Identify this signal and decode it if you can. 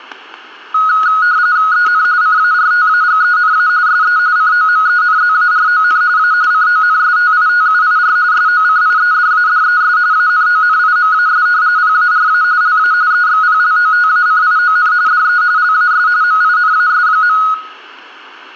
RTTY (45.45 baud, 170 Hz shift), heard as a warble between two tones, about 1360 Hz centre, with static crashes and room echo. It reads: EN CARTAGENA SE COMENZARON A CONSTITUIR SOCIEDADES ANONIMAS PARA LA EXPLOTACION DE LAS MINAS.